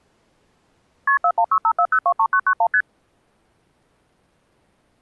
Multi-frequency trunk signalling (R1, as on North American trunks), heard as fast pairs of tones, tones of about 70 ms. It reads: KP 41654023991 ST